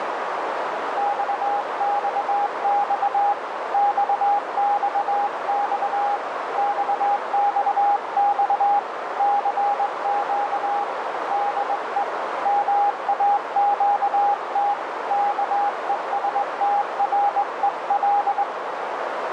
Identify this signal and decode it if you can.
Morse code, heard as a keyed tone, hand-sent with a straight key, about 21 wpm, 810 Hz, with heavy radio static and a narrow filter. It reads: XXX XXX XXX CQ DE MAQT KESTREL